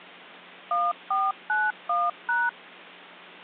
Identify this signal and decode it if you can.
DTMF, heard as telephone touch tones, dialled by machine, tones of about 210 ms. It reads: 1491#